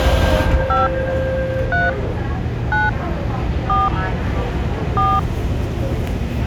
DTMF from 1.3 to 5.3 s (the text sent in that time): 3 9 4 4